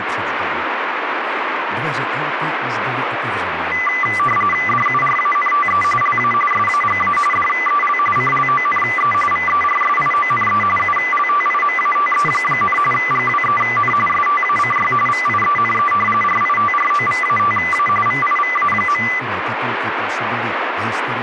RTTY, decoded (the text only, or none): DURANTE LA SAGA DEL CLONE VERSIONE ULTIMATE, GWEN STACY VIENE RITROVATA VIVA.